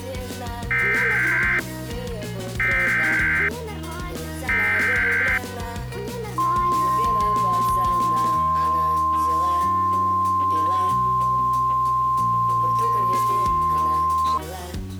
Emergency Alert System (SAME) tones (header bursts, then the 1050 Hz attention tone), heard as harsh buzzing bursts, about 520.83 baud.